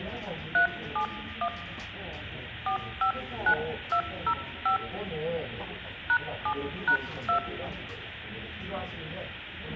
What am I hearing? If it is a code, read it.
DTMF, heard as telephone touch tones, dialled by hand, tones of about 90 ms, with the noise of a crowd indoors. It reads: 371 459205 #7#2